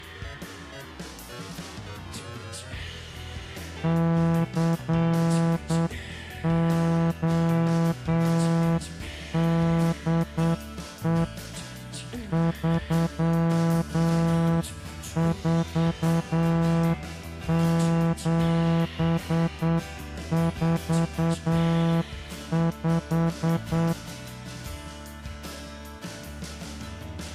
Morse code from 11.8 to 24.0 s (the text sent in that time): 34745